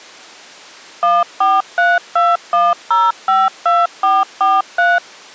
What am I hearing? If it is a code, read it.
DTMF, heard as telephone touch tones, dialled by machine, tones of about 200 ms. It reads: 14321052443